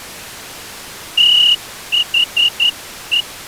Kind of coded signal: Morse code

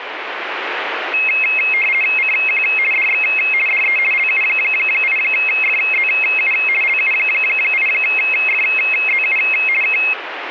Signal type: RTTY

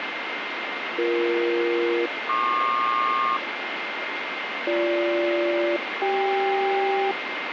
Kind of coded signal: aircraft SELCAL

